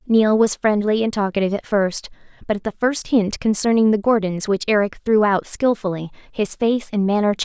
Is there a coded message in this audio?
No, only speech in English.